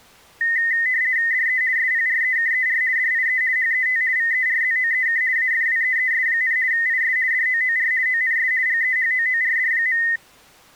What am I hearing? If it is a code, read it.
RTTY (50 baud, 170 Hz shift), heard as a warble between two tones, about 1950 Hz centre. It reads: DE SPREKER DIE HET VERZOEK AFWEES, IS DOOR ONS GEHOORD.